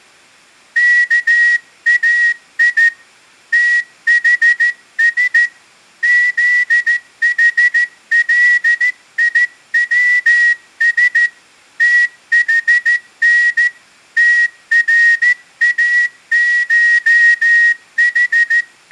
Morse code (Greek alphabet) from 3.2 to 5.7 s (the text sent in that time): ΤΗΣ